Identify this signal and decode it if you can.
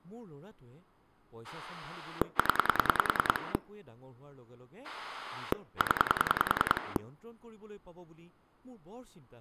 Pulse dialling, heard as a rotary dial, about 10 pulses a second, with speech in Assamese. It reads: 0 0